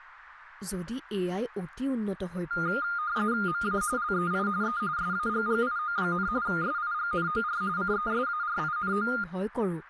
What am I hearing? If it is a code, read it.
RTTY (45.45 baud, 170 Hz shift), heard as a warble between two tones, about 1320 Hz centre, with radio static and speech in Assamese. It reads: MA LEI E SAGGIO, SIGNOR CESARINO